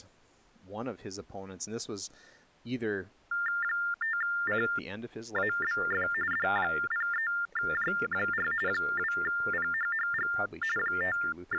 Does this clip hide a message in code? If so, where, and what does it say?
Yes: TTY/TDD text telephone tones (45.45 baud Baudot) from 3.3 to 11.6 s, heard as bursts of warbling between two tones, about 400 Hz shift, 1600 Hz centre, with speech in English. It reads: 5CABF D03J4 2PHHG …